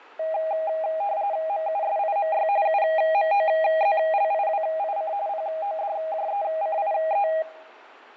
RTTY (45.45 baud, 170 Hz shift), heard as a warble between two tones, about 720 Hz centre, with fading. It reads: MUSIMY UMOZLIWIC PODJECIE